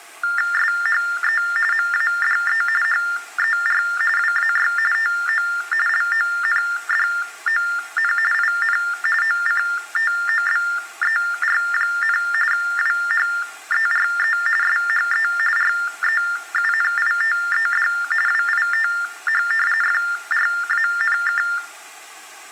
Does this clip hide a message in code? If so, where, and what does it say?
Yes: TTY/TDD text telephone tones (45.45 baud Baudot) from 0.2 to 21.6 s, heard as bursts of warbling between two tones, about 400 Hz shift, 1600 Hz centre. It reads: SHE MADE HER WAY TO LONDON IN OCTOBER, WHERE SHE REUNITED WITH FRANK